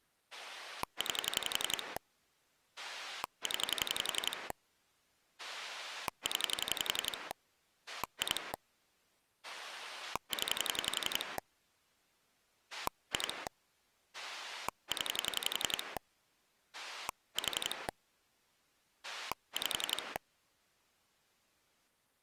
Pulse dialling, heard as a rotary dial, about 11 pulses a second. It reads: 9 0 0 2 0 2 0 4 5